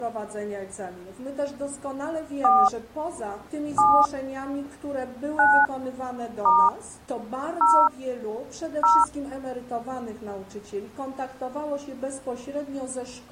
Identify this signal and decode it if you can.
DTMF, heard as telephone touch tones, dialled by hand, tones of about 290 ms. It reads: 4 7 9 * 0 0